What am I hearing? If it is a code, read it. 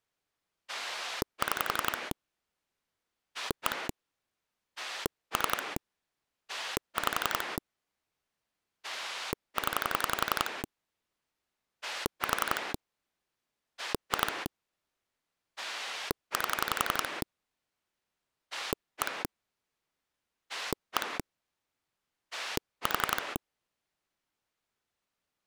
Pulse dialling, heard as a rotary dial, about 11 pulses a second. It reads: 6 1 3 5 0 4 2 8 1 1 4